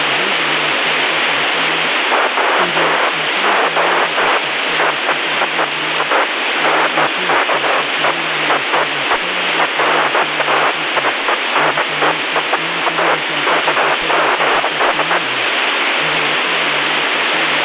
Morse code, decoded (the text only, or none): none